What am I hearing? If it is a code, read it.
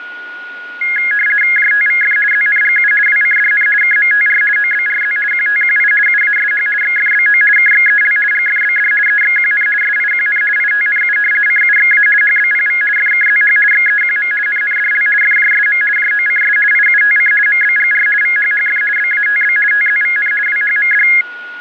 RTTY (50 baud, 450 Hz shift), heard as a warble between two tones, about 1900 Hz centre, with a steady whistle near 1450 Hz. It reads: JTVF ZNGU WCDN KMTR OBRZ QTQI UASH XFBO KXEL GFBD EXQN SIQN ITNU CUXA HBPV FKZH XEQM NNDL FJSM JOCS IUTC MBGR VHHF BATB TZVN WHMD